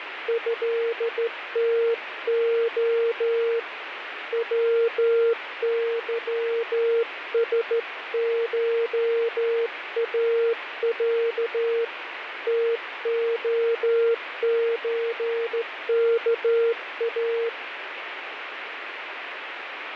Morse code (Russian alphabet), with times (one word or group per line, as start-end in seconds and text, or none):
0.3-3.6 ЭТО
4.3-11.8 ВЫСШАЯ
12.5-17.5 ТОЧКА